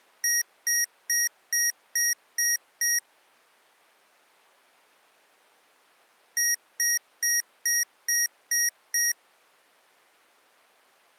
Beep code, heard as beeps from a small speaker, played twice, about 1900 Hz. 7 short. In AMI BIOS tables: virtual mode exception error; in Dell tables: processor failure.